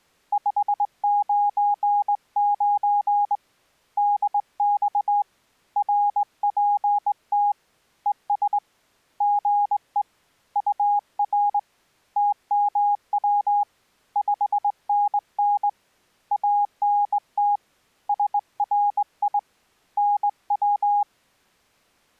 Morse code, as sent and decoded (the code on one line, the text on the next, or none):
..... ----. ----. / -.. -..- / .-. .--. - / . ... / --. . / ..- .-. / - -- .-- / ..... -. -. / .- -. - / ... .-. .. / -. .--
599 DX RPT ES GE UR TMW 5NN ANT SRI NW